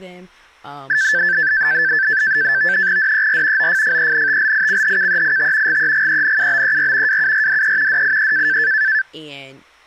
NAVTEX (SITOR-B), 100 baud, 170 Hz shift, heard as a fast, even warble, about 1650 Hz centre, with speech in English. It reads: DER OFFENTLICHKEIT GEGENUBER WURDE DIE